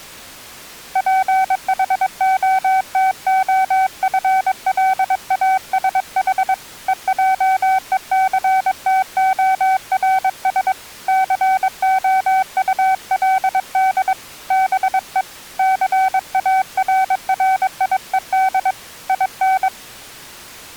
Morse code, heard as a keyed tone, hand-sent with a paddle, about 22 wpm, 760 Hz. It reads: PHOTOFLASH EJECTORS COULD BE CARRIED IN